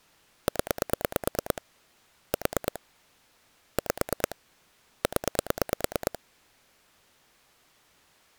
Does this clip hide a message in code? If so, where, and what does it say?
Yes: pulse dialling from 0.5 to 6.2 s, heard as clicks on a phone line, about 9 pulses a second. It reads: 0 4 5 0